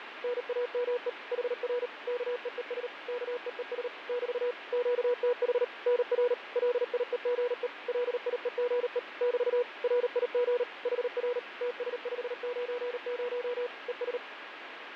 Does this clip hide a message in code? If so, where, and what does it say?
Yes: Morse code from 0.2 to 14.2 s, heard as a keyed tone, machine-sent, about 38 wpm, 490 Hz, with radio static and fading. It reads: NAME HR KEES KEES <BT> QTH NR LIEGE LIEGE <BT> RIG HR TS590 ES